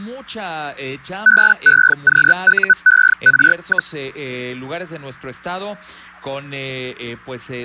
Hellschreiber (Feld-Hell, 122.5 baud), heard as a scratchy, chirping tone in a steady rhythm, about 1500 Hz. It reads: BEQUER,